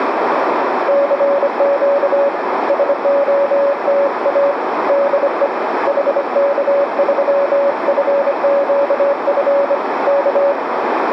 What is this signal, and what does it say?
Morse code, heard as a keyed tone, hand-sent with a bug key, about 25 wpm, 560 Hz, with radio static and a narrow filter. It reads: CQ SOTA DE HK3FQF K